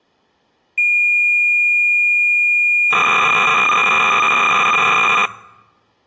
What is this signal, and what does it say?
Cassette data (Kansas City type), 300 baud, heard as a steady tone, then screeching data.